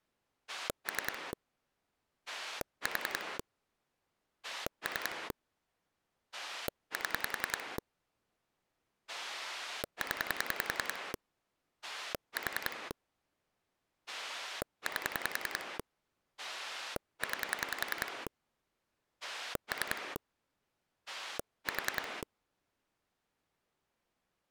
Pulse dialling, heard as a rotary dial, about 10 pulses a second. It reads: 3 4 3 7 0 4 8 9 3 4